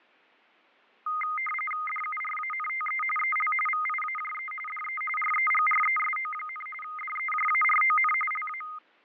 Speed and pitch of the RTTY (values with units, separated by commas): 45.45 baud, 850 Hz shift, 1650 Hz centre